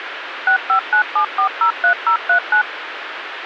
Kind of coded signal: DTMF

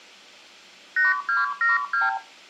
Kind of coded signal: multi-frequency trunk signalling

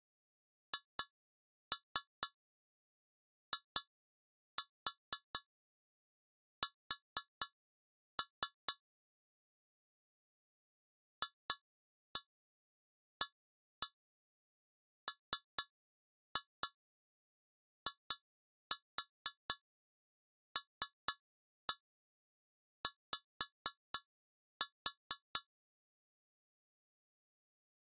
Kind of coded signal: tap code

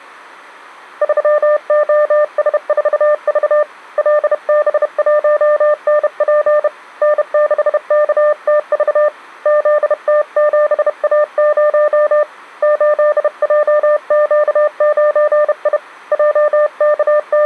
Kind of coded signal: Morse code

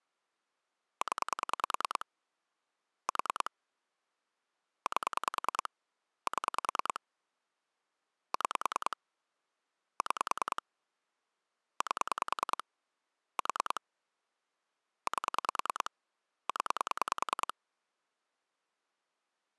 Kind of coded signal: pulse dialling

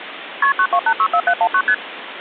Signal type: multi-frequency trunk signalling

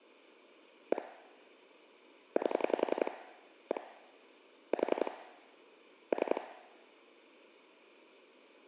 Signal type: pulse dialling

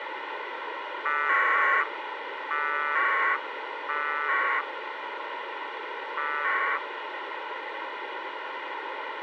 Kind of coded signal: packet radio (AX.25, as in APRS)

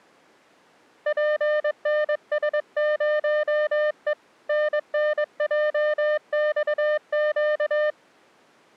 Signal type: Morse code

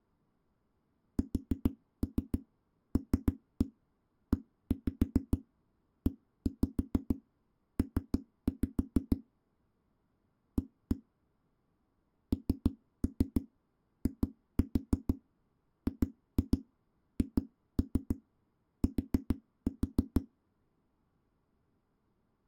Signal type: tap code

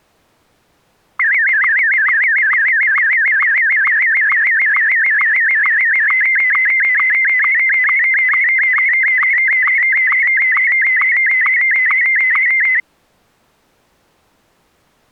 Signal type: SSTV (slow-scan television)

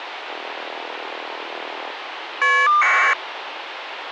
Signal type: caller ID data burst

